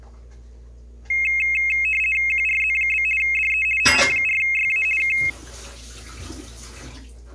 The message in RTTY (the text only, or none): QRZ? DE OM4YA K